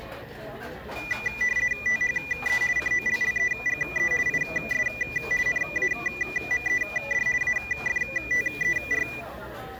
RTTY (50 baud, 450 Hz shift), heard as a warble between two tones, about 2200 Hz centre, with room echo and the noise of a restaurant. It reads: THE COLLEGE IS NAMED AFTER